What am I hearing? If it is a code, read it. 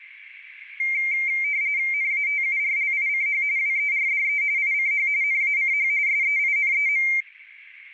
RTTY (45.45 baud, 170 Hz shift), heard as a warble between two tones, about 2200 Hz centre, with radio static. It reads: NATURLICH WERDE ICH NACH SEINEM